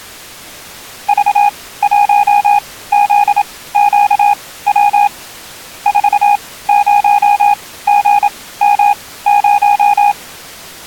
Morse code, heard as a keyed tone, machine-sent, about 27 wpm, spaced as for 17 wpm, 820 Hz. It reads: V1ZQW 40GM0